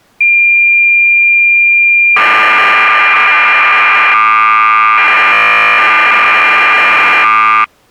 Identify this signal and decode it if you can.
Cassette data (Kansas City type), 1200 baud, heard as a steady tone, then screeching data.